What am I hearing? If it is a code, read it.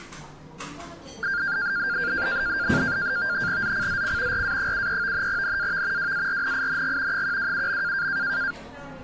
NAVTEX (SITOR-B), 100 baud, 170 Hz shift, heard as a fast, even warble, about 1500 Hz centre, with the noise of a cafe. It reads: ZCZC RA73 NAV WARNING 127.